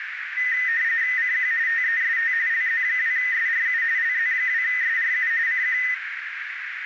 RTTY (45.45 baud, 170 Hz shift), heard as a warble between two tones, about 1900 Hz centre, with radio static and a narrow filter. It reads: CQ TEST LZ2SRU LZ2SRU CQ